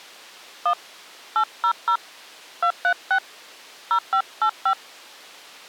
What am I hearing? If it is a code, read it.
DTMF, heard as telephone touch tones, dialled by hand, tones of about 80 ms. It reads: 1 800 236 0585